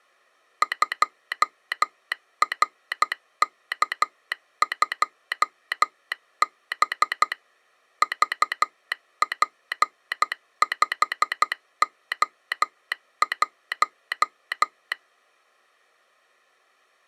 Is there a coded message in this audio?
Yes: Morse code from 0.6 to 15.0 s, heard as a telegraph sounder, machine-sent, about 12 wpm. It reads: 2RK2B VP5O1